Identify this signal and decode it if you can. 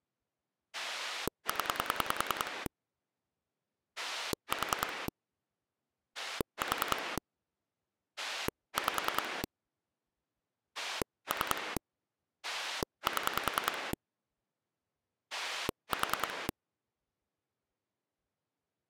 Pulse dialling, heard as a rotary dial, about 10 pulses a second. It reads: 0 4 4 5 3 7 4